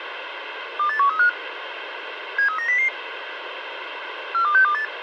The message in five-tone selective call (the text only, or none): 28135 73900 42628